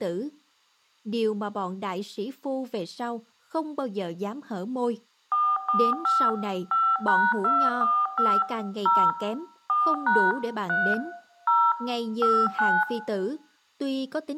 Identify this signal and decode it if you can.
DTMF, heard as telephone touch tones, dialled by machine, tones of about 250 ms, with room echo and speech in Vietnamese. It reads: 445 5#245 0 4# 3 0 59